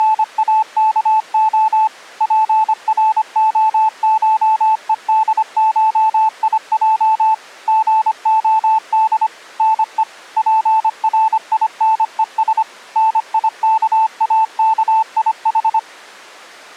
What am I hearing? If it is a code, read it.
Morse code (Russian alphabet), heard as a keyed tone, machine-sent, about 25 wpm, 880 Hz. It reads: … ПРОШЕДШИЙ ГОД НЕ ПРИНЕС НИКАКИХ